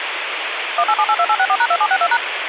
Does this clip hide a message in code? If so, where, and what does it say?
Yes: DTMF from 0.8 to 2.2 s, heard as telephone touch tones, dialled by machine, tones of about 60 ms, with phone line noise. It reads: 18782864#2762#